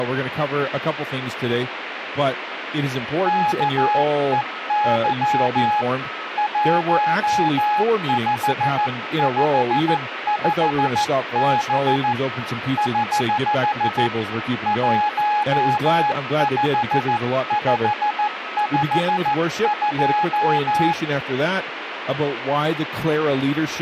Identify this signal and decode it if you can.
Morse code, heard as a keyed tone, hand-sent with a paddle, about 14 wpm, 840 Hz, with radio static and a weaker station near 1280 Hz. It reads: KEY 1555B <HH> 15552